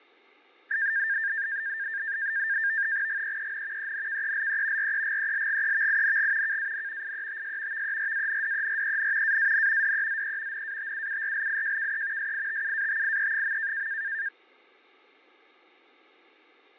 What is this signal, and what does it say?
NAVTEX (SITOR-B), 100 baud, 170 Hz shift, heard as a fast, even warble, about 1700 Hz centre, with fading. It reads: GEEN ENKELE REGELGEVING KAN IETS VERANDEREN AAN DEZE NATUURLIJKE SITUATIE.